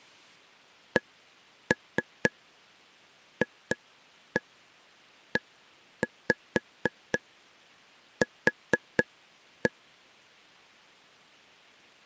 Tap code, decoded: CFEQ

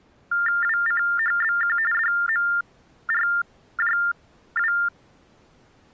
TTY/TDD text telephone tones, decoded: WCHBQ DMRJW

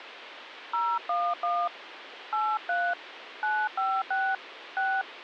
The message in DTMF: 011 83 956 6

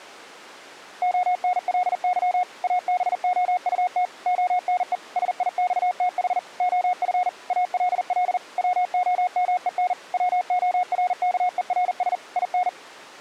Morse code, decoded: ONLY ABOUT ONE SIXTH OF ALL WOMEN WORKERS IN

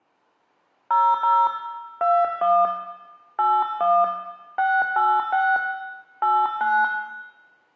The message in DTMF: 00 21 81 686 89

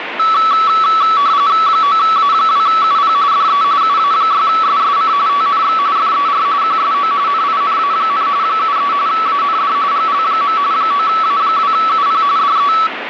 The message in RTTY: 9A2UP DE UA6SSC TNX FER QSO NINA, 73 AND GL. 9A2UP DE

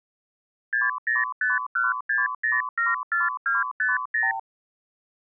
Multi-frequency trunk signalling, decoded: 60516074250

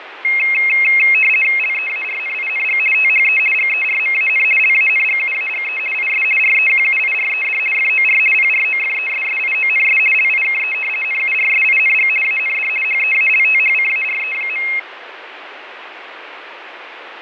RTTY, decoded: LEARNING THE GERMAN LANGUAGE IS REQUIRED FOR PROFESSIONS LIKE NURSING AND HEALTHCARE.

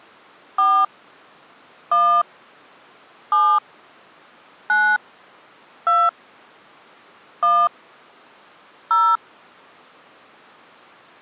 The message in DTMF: 4 1 7 9 2 1 0

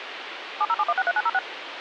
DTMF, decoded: 707163906

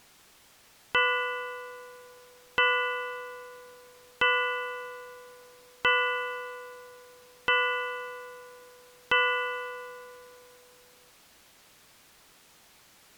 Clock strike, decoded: 6

